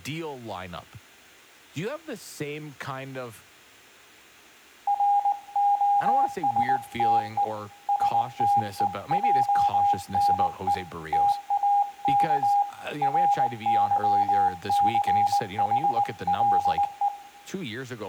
Morse code, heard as a keyed tone, hand-sent with a paddle, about 19 wpm, 810 Hz, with room echo and speech in English. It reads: ROSTE STEJNE TAK RYCHLE